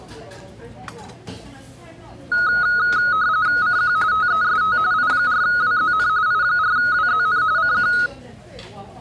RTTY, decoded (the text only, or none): CQ TEST I4WZN I4WZN CQ